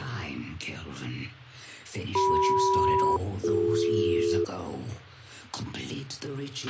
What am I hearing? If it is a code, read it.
Aircraft SELCAL, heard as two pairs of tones, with a squelch burst at the end. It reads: CM-BD